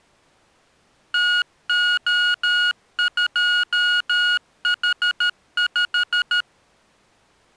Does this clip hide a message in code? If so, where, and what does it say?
Yes: Morse code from 1.1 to 6.5 s, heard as electronic beeps, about 13 wpm, 1440 Hz. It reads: TO2H5